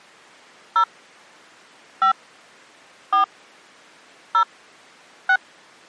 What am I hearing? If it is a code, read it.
DTMF, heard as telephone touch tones, dialled by hand, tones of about 90 ms. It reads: 0 5 4 0 6